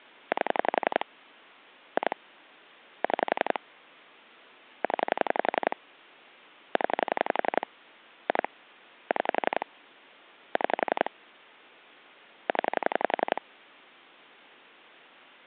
Pulse dialling, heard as clicks on a phone line, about 11 pulses a second. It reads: 8 2 6 0 0 2 6 6 0